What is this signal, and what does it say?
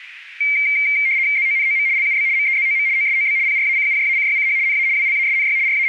RTTY (75 baud, 170 Hz shift), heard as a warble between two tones, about 2200 Hz centre, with radio static. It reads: ZONOM LUB MEZOM OSOB PRACUJACYCH NA WLASNY …